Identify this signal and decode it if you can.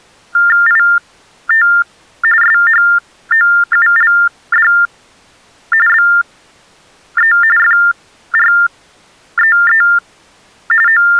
TTY/TDD text telephone tones (45.45 baud Baudot), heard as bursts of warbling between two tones, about 400 Hz shift, 1600 Hz centre. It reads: IT SHOULD BE FREE …